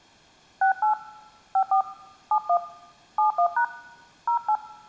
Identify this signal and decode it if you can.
DTMF, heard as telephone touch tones, dialled by hand, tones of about 100 ms. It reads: 68 54 71 71# 08